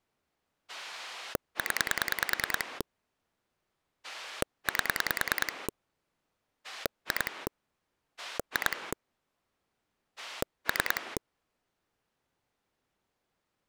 Pulse dialling, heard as a rotary dial, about 10 pulses a second. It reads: 0 8 2 2 3